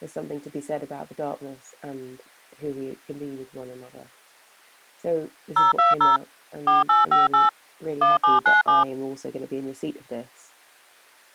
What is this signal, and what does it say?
DTMF, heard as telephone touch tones, dialled by machine, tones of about 160 ms. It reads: 020 4858 1797